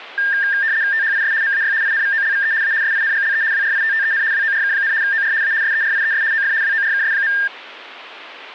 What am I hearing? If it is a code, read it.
RTTY (75 baud, 170 Hz shift), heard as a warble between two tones, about 1700 Hz centre. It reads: THIS MAY INVOLVE A SINGLE WRITTEN WORK, OR A SERIES OF WORKS.